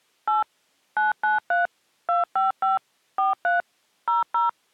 DTMF, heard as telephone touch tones, dialled by machine, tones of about 150 ms. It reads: 8 993 255 43 00